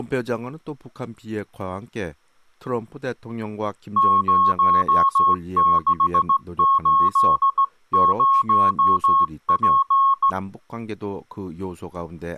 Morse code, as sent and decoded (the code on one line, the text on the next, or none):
----- -.... ---.. ----- .--.
0680P